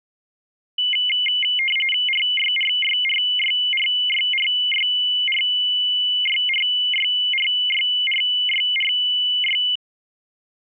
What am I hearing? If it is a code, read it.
RTTY (45.45 baud, 850 Hz shift), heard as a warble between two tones, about 2550 Hz centre. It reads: RYRYRYRYRYRYRYRYRYRY